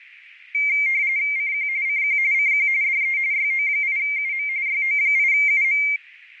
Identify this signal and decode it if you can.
RTTY (45.45 baud, 170 Hz shift), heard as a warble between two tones, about 2200 Hz centre, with radio static. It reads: CQ CQ CQ DE YO8UM YO8UM